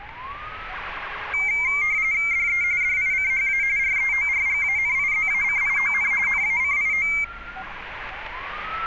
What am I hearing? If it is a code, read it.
RTTY (45.45 baud, 170 Hz shift), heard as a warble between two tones, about 2200 Hz centre, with street noise. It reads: DE DICHA REORGANIZACION NACIO